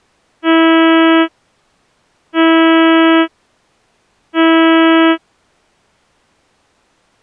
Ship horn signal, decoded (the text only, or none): 3 short